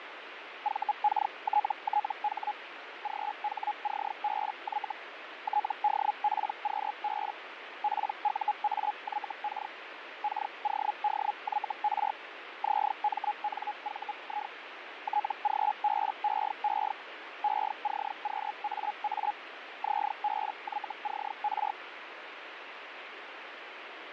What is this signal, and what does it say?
Hellschreiber (Feld-Hell, 122.5 baud), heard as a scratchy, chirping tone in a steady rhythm, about 840 Hz, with radio static and fading. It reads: VKTTH GHCBY TDPQB PUAYK KODYR ZMNVI TGBEE ECQAA ZBYCR